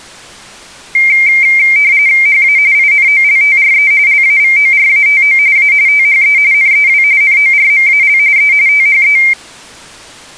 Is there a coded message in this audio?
Yes: RTTY (45.45 baud, 170 Hz shift) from 0.9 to 9.3 s, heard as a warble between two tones, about 2200 Hz centre. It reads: HA INOLTRE LAVORATO A THE NEW NORMAL E THE